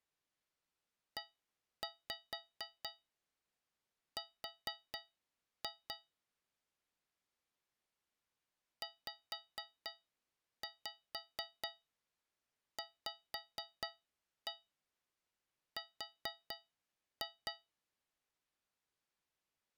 Tap code, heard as taps on a metal pipe, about 4 knocks a second. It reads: ER ZVR